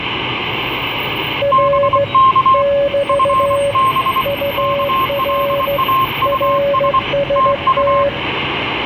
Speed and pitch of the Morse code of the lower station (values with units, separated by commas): 15 wpm, 560 Hz